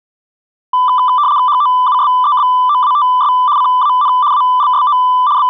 RTTY (75 baud, 170 Hz shift), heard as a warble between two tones, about 1090 Hz centre. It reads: HOUSEBOATS CAN ALSO …